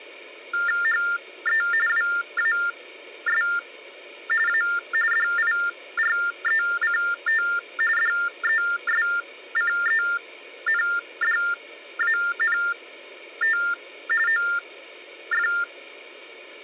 TTY/TDD text telephone tones (45.45 baud Baudot), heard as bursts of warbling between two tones, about 400 Hz shift, 1600 Hz centre. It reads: HE WAS A DIRECT DESCENDANT OF